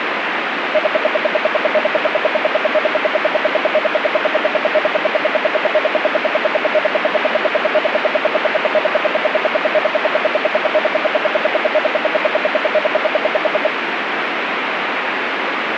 Radio time signal (RWM, Moscow), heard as ten pulses a second, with radio static.